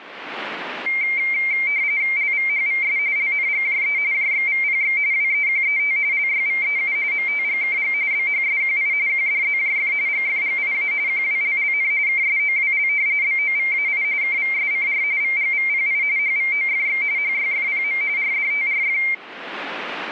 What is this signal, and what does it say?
RTTY (45.45 baud, 170 Hz shift), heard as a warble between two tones, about 2200 Hz centre. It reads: LVHVS LNGJE JXVPX WEQET LYVEU MTGKG BHSQI QDZJF GFGIA QWLLN KSOWL BOVAI KVSCR VGVPI HVOFX HYFPM RDTRF